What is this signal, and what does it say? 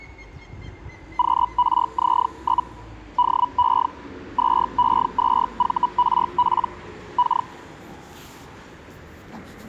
Hellschreiber (Feld-Hell, 122.5 baud), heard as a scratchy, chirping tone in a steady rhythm, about 980 Hz, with street noise. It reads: QRZ? DE 2E2VRP K